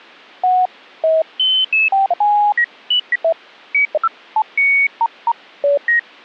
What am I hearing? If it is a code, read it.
Electronic bleeps of random pitch and length. There is no code.